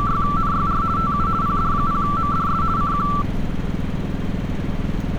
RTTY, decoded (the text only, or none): … TU PD0MDS CQ